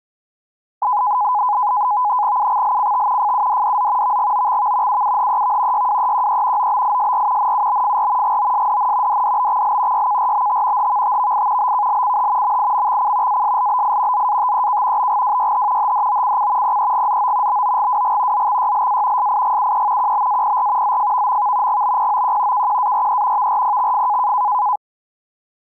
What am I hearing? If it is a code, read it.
NAVTEX (SITOR-B), 100 baud, 170 Hz shift, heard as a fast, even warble, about 920 Hz centre. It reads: UXLCT FUDDZ VGOXV UUHEV YWEQE OBISR NUBFR GOSDN DDBXL YKRBT HVTVI BKLCH MIMXC ASLBI ZATEK BGWYH HDOCC PEGZO BOGWG ZXYLA SIGUE QBAPR ZFVMV GBPOQ KQARE VRPXF